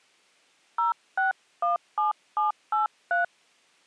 DTMF, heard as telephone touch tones, dialled by hand, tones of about 140 ms. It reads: 0617783